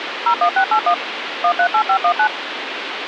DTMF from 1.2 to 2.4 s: 138519

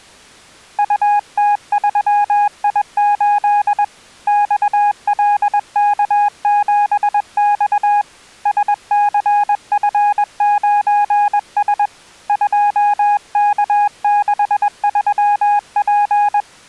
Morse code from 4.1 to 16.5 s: XLK7X SCF9S 2K63P

